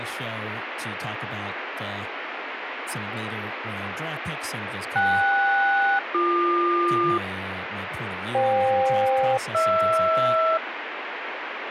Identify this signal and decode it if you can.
Aircraft SELCAL, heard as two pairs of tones, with radio static and speech in English. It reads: KS-BQ FK-HR